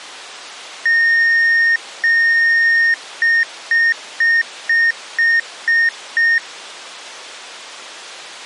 Beep code, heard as beeps, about 1850 Hz. 2 long, 7 short.